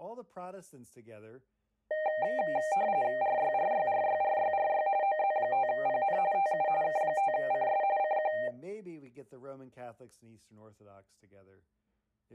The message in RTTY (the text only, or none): RYRYRYRYRY OZ5PN TU K5CS CQ